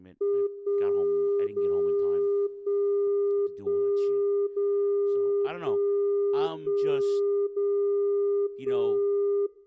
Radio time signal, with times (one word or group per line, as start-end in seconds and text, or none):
0.5-1.5 1
1.5-2.5 0
2.5-3.5 1
3.5-4.5 1
4.5-5.5 0
5.5-6.5 1
6.5-7.5 1
7.5-8.5 0
8.5-9.5 1